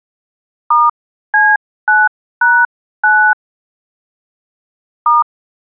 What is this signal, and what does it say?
DTMF, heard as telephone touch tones, dialled by hand, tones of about 240 ms. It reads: *C9#9 *